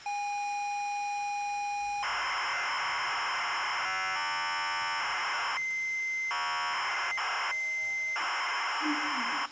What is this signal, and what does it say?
ZX Spectrum tape loading, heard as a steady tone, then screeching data, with the noise inside a lift.